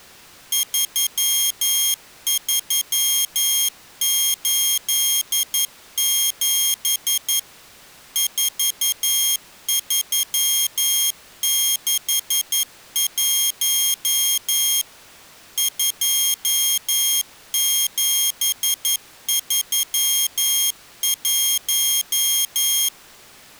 Morse code, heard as a high beeper, machine-sent, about 11 wpm, 3250 Hz. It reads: 3387 4361 2731